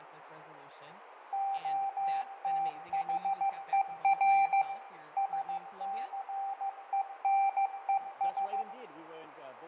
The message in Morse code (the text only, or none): OTHER SCENES